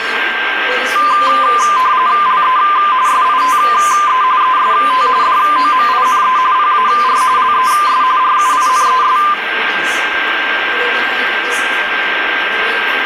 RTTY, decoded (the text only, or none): LE SITE EST DOMINE PAR LES RUINES